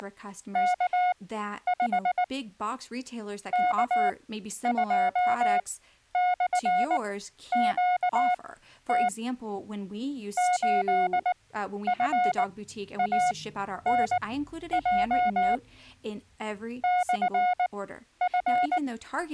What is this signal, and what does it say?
Morse code, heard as a keyed tone, machine-sent, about 19 wpm, spaced as for 11 wpm, 720 Hz, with speech in English. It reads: … K2/QT 8FANJ …